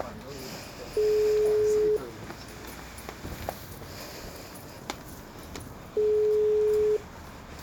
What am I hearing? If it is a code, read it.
Telephone call progress tone (single-tone plan, as in most of Europe), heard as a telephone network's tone, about 420 Hz, 1 s on and 4 s off, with street noise. Ringback tone.